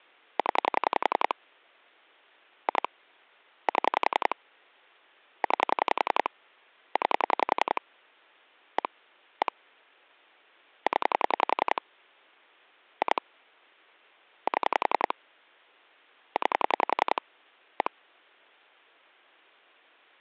Pulse dialling, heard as clicks on a phone line, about 11 pulses a second. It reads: 0 2 7 9 9 1 1 0 2 7 9 1